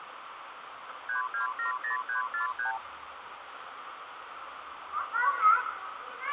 Multi-frequency trunk signalling (R2, with the far end's replies), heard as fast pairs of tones, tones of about 120 ms, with phone line noise and the noise of a park. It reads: 3270343